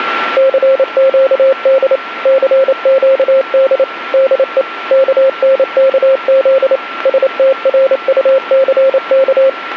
Morse code, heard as a keyed tone, machine-sent, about 28 wpm, 530 Hz, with radio static and a steady whistle near 1360 Hz. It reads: CQD CQD DE KNKZ STRUCK